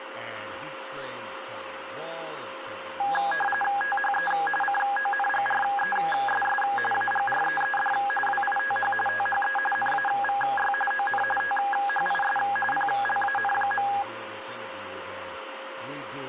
RTTY (45.45 baud, 850 Hz shift), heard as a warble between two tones, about 1230 Hz centre, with radio static, a steady whistle near 530 Hz and speech in English. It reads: THE CONGRESS AGREED WITH THE NAVY ON THIS PLAN.